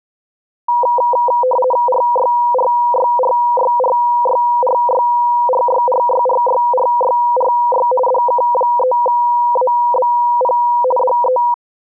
RTTY (50 baud, 450 Hz shift), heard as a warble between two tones, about 740 Hz centre. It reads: RYRYRYRYRYRYRYRYRYRY DK3ABP DE